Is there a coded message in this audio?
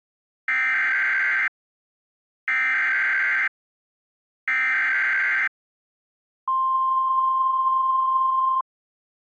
Yes: Emergency Alert System (SAME) tones (header bursts, then the 1050 Hz attention tone) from 0.5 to 8.6 s, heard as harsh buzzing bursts, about 520.83 baud.